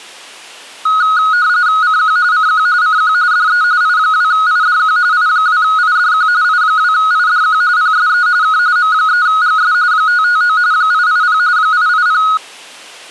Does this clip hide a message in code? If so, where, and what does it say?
Yes: RTTY (45.45 baud, 170 Hz shift) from 0.9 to 12.4 s, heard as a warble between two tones, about 1360 Hz centre. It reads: CQ CQ CQ DE I2IDQ I2IDQ I2IDQ PSE K M3GS 559 880 880